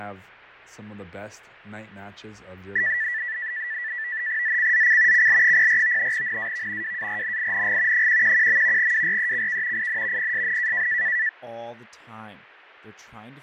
NAVTEX (SITOR-B), 100 baud, 170 Hz shift, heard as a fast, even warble, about 1850 Hz centre, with fading and speech in English. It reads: ZCZC CL04 NAV WARNING 111. WRECK IN PSN